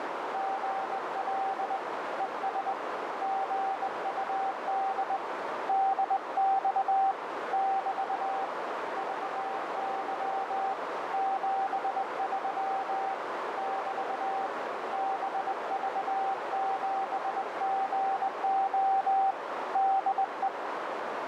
Morse code, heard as a keyed tone, hand-sent with a straight key, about 20 wpm, 780 Hz, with heavy radio static and a narrow filter. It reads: GL ES GUD DX <BT> VY 73 <BT> BV7GO DE